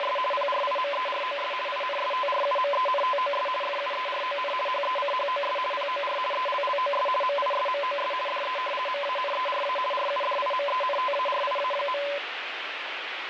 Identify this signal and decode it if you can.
RTTY (50 baud, 450 Hz shift), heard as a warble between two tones, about 800 Hz centre, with radio static. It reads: … PRIMEROS INSTRUMENTOS FUERON HECHOS POR ELLOS MISMOS DE MANERA RUDIMENTARIA.